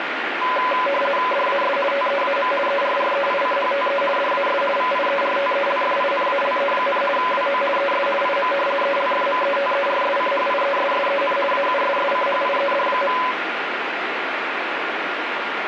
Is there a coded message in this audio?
Yes: RTTY (50 baud, 450 Hz shift) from 0.4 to 13.3 s, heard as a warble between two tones, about 780 Hz centre, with radio static. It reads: DAS TEAM ERREICHTE DAS VIERTELFINALE, WO ES IM ELFMETERSCHIESSEN AUSSCHIED.